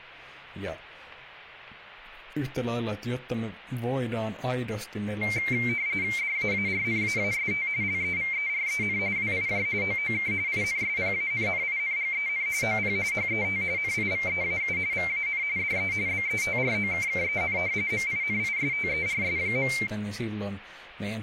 RTTY (45.45 baud, 170 Hz shift), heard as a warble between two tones, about 2200 Hz centre, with speech in Finnish. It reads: DAARNAAST LEVEREN WIJ OOK INSPANNINGEN OP HET NIVEAU VAN DE BETROKKEN MINISTERS.